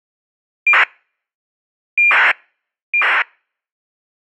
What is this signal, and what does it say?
ACARS aircraft data, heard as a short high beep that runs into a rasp, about 2400 baud.